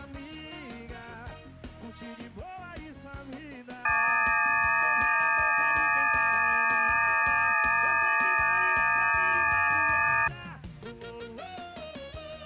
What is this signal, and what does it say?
FT8 (several signals at once), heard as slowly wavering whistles, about 6.25 baud.